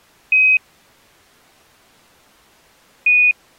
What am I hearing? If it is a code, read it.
Quindar tones, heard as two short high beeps.